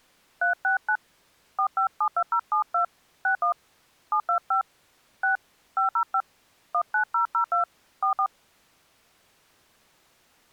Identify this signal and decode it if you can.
DTMF, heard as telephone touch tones, dialled by hand, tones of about 90 ms. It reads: 369 4572072 61 725 6 505 19002 44